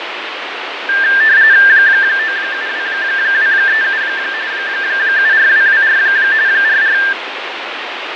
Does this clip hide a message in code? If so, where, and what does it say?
Yes: RTTY (45.45 baud, 170 Hz shift) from 0.9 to 7.1 s, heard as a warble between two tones, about 1700 Hz centre, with radio static and fading. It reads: 972237 74224 44